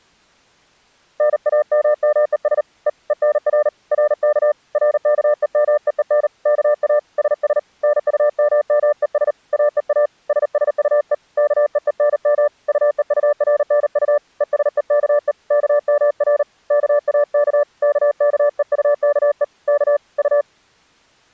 Morse code, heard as a keyed tone, hand-sent with a paddle, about 38 wpm, 590 Hz. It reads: NAMMES E ENR RK RKEMEEN KA SS NUMMES AEA SSUE KEENM UEURNU ESEKE KMR KAK KKEUKE K U